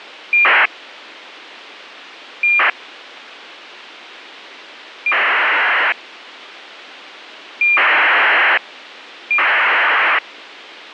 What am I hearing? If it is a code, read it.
ACARS aircraft data, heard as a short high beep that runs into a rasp, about 2400 baud, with radio hiss.